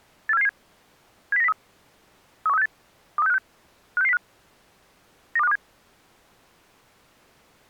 Five-tone selective call (EEA), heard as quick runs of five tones, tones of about 40 ms. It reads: 84777 70903 31368 23656 56605 92527